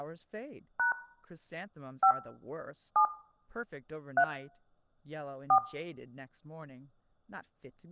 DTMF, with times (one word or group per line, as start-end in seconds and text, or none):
0.8-0.9 #
2.0-2.1 5
3.0-3.0 7
4.2-4.2 3
5.5-5.6 4